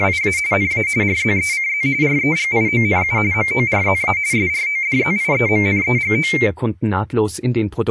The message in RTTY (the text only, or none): … NA RZECZ REGIONU MORZA SRODZIEMNEGO